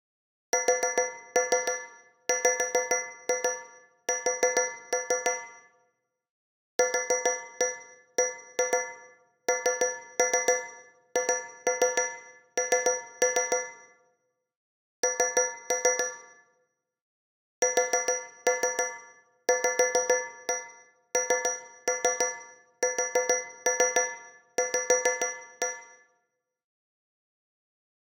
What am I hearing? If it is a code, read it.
Tap code, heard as taps on a metal pipe, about 6 knocks a second, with room echo. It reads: SWS QBNHN N SVNSV